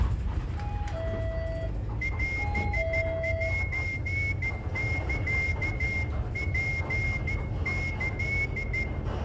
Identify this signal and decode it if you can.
Morse code (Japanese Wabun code), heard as a whistle, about 13 wpm, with room echo and the noise inside a bus. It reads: オセサツキ